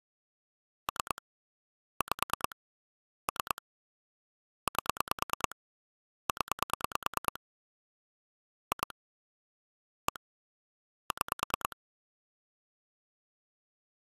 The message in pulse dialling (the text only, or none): 3 5 3 8 0 2 1 6